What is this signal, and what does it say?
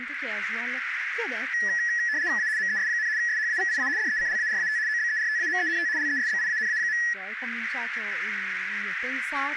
RTTY (75 baud, 170 Hz shift), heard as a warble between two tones, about 1800 Hz centre, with radio static, a narrow filter and speech in Italian. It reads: A MES, SHAVIA DECLARAT OBERTAMENT LESBIANA.